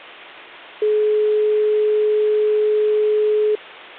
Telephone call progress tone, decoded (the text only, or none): dial tone